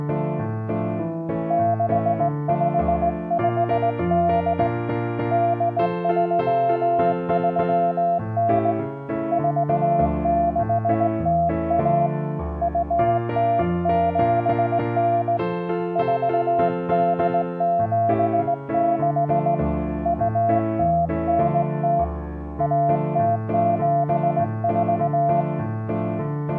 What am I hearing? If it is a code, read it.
Morse code (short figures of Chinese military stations), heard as a keyed tone, hand-sent with a straight key, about 18 wpm, 690 Hz. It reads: 6558 8339 4601 2079 4876 2090 1074